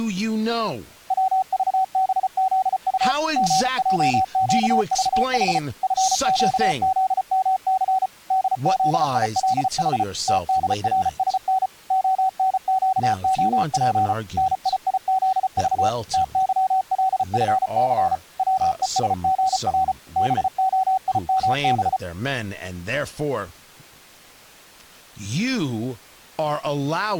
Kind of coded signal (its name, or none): Morse code